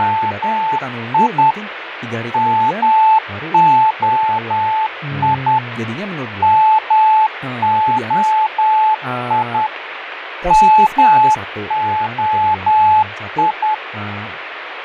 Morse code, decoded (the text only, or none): … MOI MOI MOI